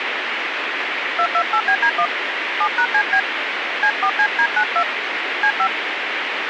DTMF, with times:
1.2-2.1 228BD1
2.6-3.2 7#CB
3.8-4.8 C4CD92
5.4-5.7 C5

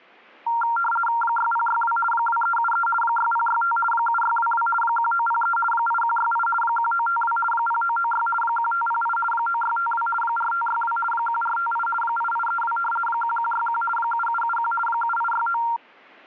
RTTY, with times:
1.2-2.0 6062
2.1-2.9 2373
3.0-3.8 6065
3.9-4.7 7622
4.8-5.6 1903
5.7-6.5 8168
6.6-7.4 1952
7.5-8.3 0996
8.4-9.2 1508
9.3-10.1 9652
10.2-11.0 4562
11.1-11.9 1458
12.0-12.8 8832
13.1-13.8 1161
14.0-14.7 7771
14.9-15.6 7869

